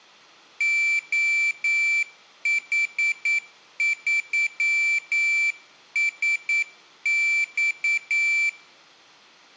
Morse code, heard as a high beeper, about 9 wpm, 2350 Hz. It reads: OH3SX